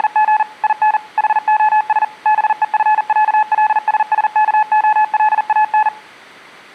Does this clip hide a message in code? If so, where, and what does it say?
Yes: Morse code (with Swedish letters) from 0.0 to 5.9 s, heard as a keyed tone, machine-sent, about 40 wpm, 860 Hz. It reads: … IN HOS BEFÄLSSKOLAN